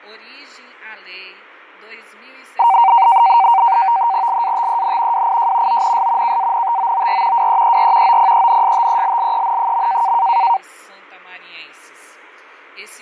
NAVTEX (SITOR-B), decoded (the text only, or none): LATEN WIJ ONS KANTOOR WEER OPENSTELLEN.